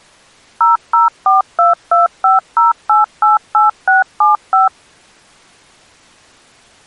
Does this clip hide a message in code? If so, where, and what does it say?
Yes: DTMF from 0.6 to 4.7 s, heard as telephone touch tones, dialled by machine, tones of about 150 ms. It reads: 0042250888675